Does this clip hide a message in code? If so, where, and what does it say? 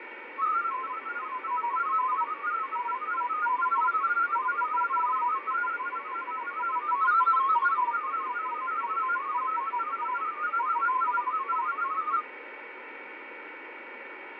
Yes: multi-tone FSK (Olivia or MFSK type), about 500 Hz wide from 0.4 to 12.2 s, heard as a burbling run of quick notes, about 31.25 baud, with radio static, fading and a steady whistle near 2250 Hz.